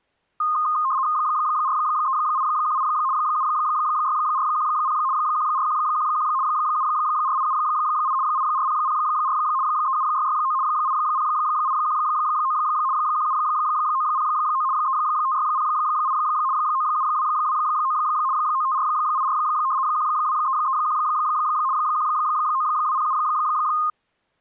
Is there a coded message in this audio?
Yes: RTTY (75 baud, 170 Hz shift) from 0.4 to 23.9 s, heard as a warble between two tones, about 1150 Hz centre. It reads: 43818 76410 14111 74878 84004 37669 80819 17909 35608 97229 95484 12331 19207